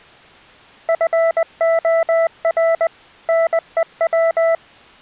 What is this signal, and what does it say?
Morse code, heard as a keyed tone, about 20 wpm, 660 Hz. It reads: FOR NEW